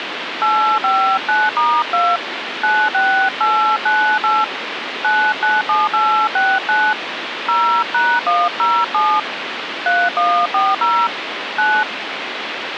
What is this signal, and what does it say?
DTMF, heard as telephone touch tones, dialled by hand, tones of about 270 ms, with phone line noise. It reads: 859*2 96898 997869 0#107 3140 9